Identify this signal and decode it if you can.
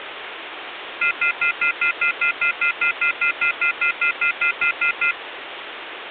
Telephone call progress tone (North American plan), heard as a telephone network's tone, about 1400, 2050, 2450, 2600 Hz, 0.1 s on and 0.1 s off, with phone line noise. Off-hook warning tone.